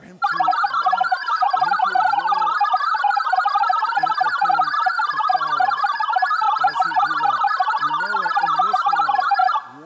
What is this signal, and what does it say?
Multi-tone FSK (Olivia or MFSK type), about 1000 Hz wide, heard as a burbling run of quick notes, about 62.5 baud, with speech in English.